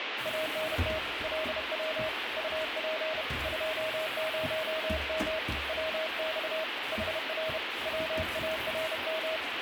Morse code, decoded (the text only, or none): ANT LW UP 20M WX HR WARM